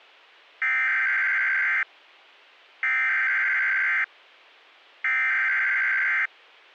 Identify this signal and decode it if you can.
Emergency Alert System (SAME) tones (header bursts), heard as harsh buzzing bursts, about 520.83 baud.